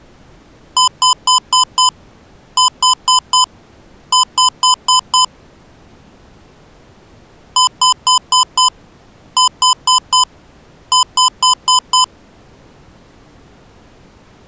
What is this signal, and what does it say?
Beep code, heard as beeps from a small speaker, played twice, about 1010 Hz. 5-4-5.